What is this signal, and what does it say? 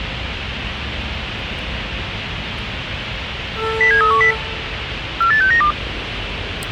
Five-tone selective call (CCIR), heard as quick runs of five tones, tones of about 100 ms, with radio hiss and the noise of a residential street. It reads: 07310 48692